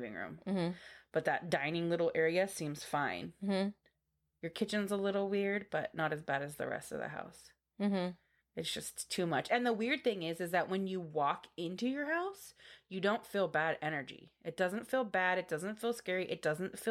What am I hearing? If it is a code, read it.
Speech in English. There is no code.